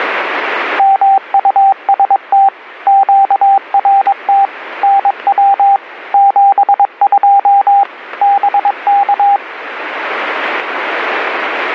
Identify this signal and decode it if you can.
Morse code, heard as a keyed tone, machine-sent, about 22 wpm, 790 Hz, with radio static. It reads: MUST QRT NW 72 BK